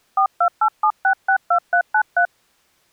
DTMF, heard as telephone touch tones, dialled by hand, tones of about 80 ms. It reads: 4287662393